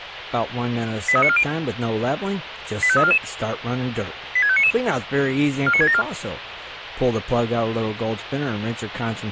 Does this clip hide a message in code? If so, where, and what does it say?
Yes: five-tone selective call (ZVEI) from 1.1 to 6.0 s, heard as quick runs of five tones, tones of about 70 ms, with radio hiss and speech in English. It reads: 83940 85344 86599 49674